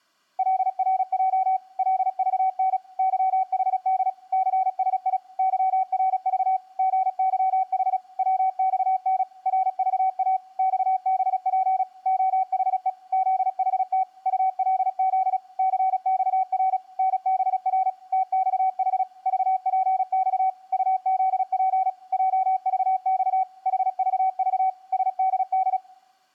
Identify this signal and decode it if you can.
Morse code, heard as a keyed tone, machine-sent, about 36 wpm, 760 Hz. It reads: LRJ LVN YHD CSI YRV GYH WXN RVA XBP OHE ZHT ULZ CXR NBR TXH VPX UZP JVX HVV SDD